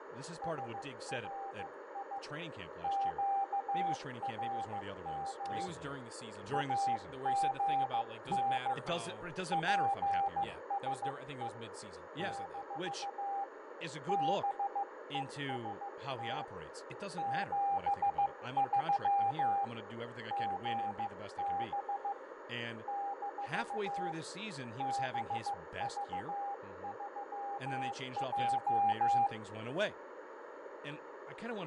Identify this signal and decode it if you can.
Morse code, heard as a keyed tone, hand-sent with a paddle, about 15 wpm, 800 Hz, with radio static, fading, a narrow filter, room echo and speech in English. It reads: SRI QRM AGN PSE - BEST 73 GB - BV3J